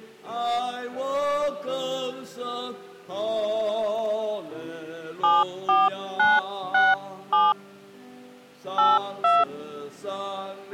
DTMF, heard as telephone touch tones, dialled by hand, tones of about 200 ms. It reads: 74967 82